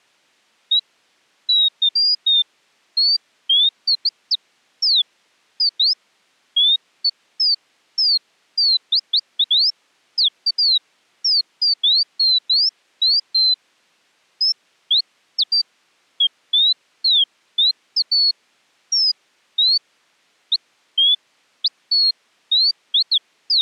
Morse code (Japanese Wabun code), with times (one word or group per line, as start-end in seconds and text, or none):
none